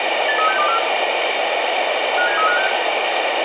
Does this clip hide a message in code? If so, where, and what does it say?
Yes: five-tone selective call (CCIR) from 0.3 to 2.7 s, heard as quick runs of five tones, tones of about 100 ms, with radio hiss and room echo. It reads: 83624 57356